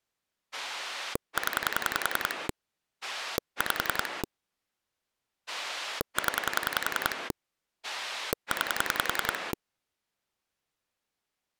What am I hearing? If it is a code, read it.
Pulse dialling, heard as a rotary dial, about 10 pulses a second. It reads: 0 5 0 9